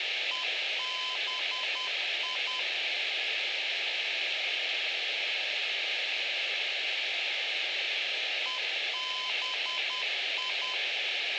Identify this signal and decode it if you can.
Morse code, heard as a keyed tone, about 10 wpm, 1020 Hz, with radio hiss and room echo. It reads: EBI EBI